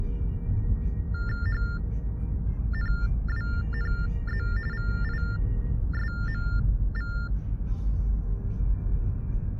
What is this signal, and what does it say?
TTY/TDD text telephone tones (45.45 baud Baudot), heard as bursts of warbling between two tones, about 400 Hz shift, 1600 Hz centre, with the noise inside a car. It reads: HNWNZ VISMV